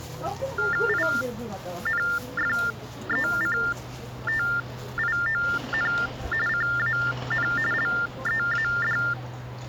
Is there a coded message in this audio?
Yes: TTY/TDD text telephone tones (45.45 baud Baudot) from 0.6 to 9.1 s, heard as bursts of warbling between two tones, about 400 Hz shift, 1600 Hz centre, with the noise of a residential street. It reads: INFECTION CAN LEAD